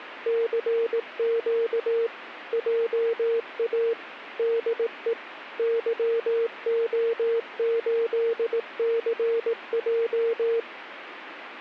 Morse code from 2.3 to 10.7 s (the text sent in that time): JA DE YO8CJ